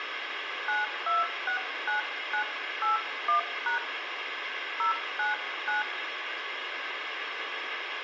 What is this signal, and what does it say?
DTMF, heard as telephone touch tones, dialled by hand, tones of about 130 ms, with radio hiss and room echo. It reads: 9269981# 099